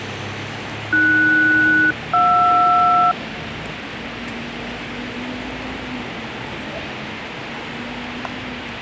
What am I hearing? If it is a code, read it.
Aircraft SELCAL, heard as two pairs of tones, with radio hiss and street noise. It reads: AS-JR